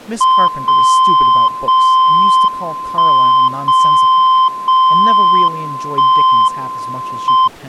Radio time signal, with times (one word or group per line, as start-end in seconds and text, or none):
0.5-1.5 0
1.5-2.5 0
2.5-3.5 1
3.5-4.5 0
4.5-5.5 0
5.5-6.5 1
6.5-7.5 M